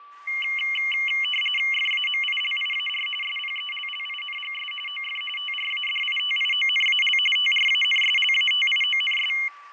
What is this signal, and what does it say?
RTTY (45.45 baud, 850 Hz shift), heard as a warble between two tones, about 2550 Hz centre, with fading, a steady whistle near 1160 Hz and street noise. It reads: FAMILIAR SPELLINGS OF TRADITIONAL TRANSLATIONS